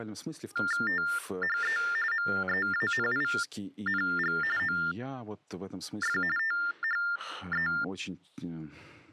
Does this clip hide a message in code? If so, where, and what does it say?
Yes: TTY/TDD text telephone tones (45.45 baud Baudot) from 0.6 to 7.8 s, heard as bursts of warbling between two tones, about 400 Hz shift, 1600 Hz centre, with speech in Russian. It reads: THE MEANING OF THE